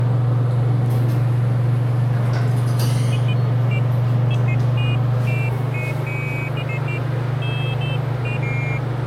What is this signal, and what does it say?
Pairs of high tones at irregular times, with the noise inside a lift. There is no code.